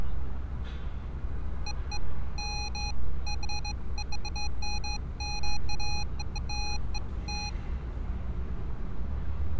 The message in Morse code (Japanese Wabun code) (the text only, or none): none